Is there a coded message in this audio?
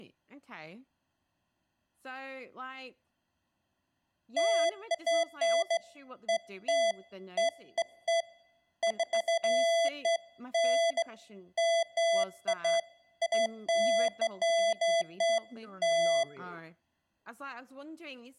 No, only beeps of irregular length, with room echo and speech in English.